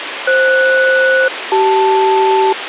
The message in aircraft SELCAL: FS-CL

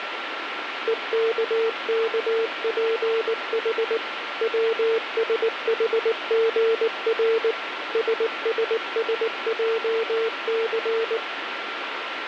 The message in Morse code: EKKPH WSHGR SSSJC

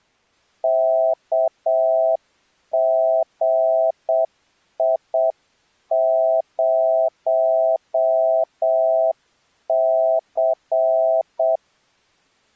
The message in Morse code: KGI0C

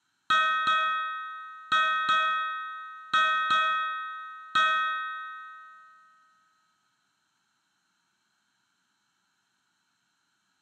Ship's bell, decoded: 7

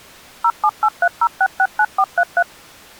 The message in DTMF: 07830669433

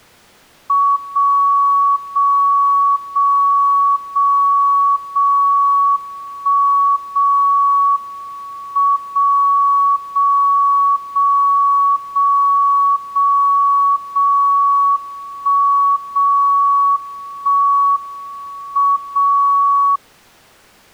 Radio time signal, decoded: 0 0 0 0 0 1 0 M 0 0 0 0 0 0 1 0 1 M 0

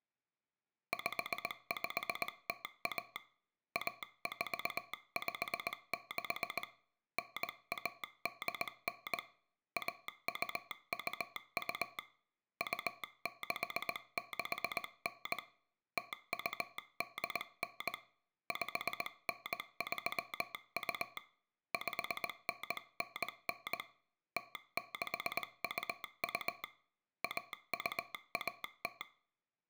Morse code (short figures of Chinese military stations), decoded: 5501 1456 9189 1222 2669 0289 5932 5999 0622 1210

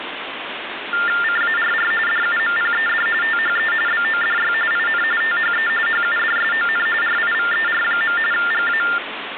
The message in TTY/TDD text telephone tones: CARR DUMPED THE BODY IN THE HUDSON RIVER. GA

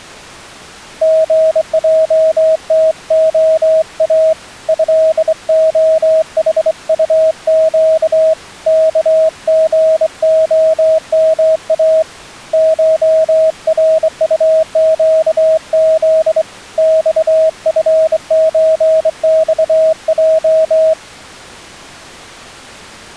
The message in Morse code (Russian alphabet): ГЙТОА ЭОХУЩ КГОМА ШРУЩЗ ЬФЧЬЙ

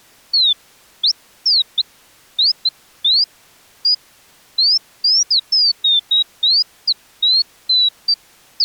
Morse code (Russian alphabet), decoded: none

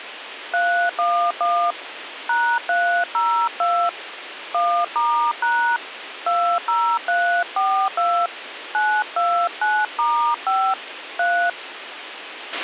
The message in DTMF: 311 #302 1*# 20342 929*5 3

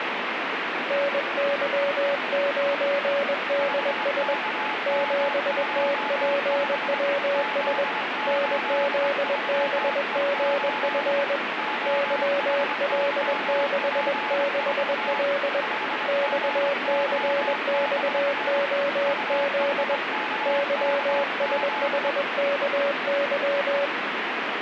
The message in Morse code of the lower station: NY9DS 7TPWS NZBGF YL66L XCXOZ YSHKY

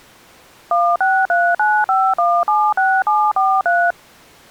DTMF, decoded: 16395176743

